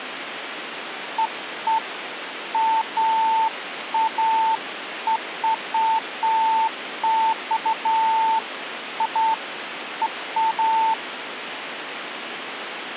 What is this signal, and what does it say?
Beeps of irregular length, with phone line noise. There is no code.